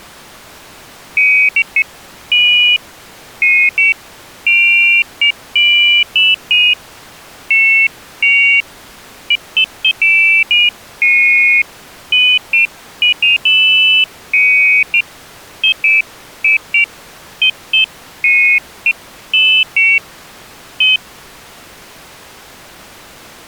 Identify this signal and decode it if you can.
Pairs of high tones at irregular times. There is no code.